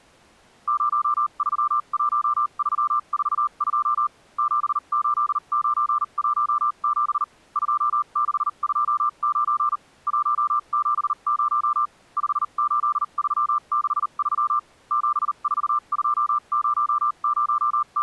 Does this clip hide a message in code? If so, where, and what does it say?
Yes: Morse code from 0.6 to 18.0 s, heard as a keyed tone, machine-sent, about 39 wpm, spaced as for 33 wpm, 1190 Hz. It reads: 031342 78917 2629 170 58363 …